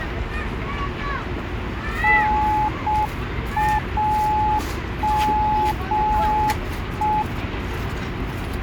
Morse code, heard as a keyed tone, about 6 wpm, 850 Hz, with radio static and the noise of a residential street. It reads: NAME